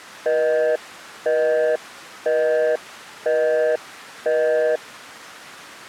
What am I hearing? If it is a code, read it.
Telephone call progress tone (North American plan), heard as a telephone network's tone, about 480, 620 Hz, 0.5 s on and 0.5 s off. Busy tone.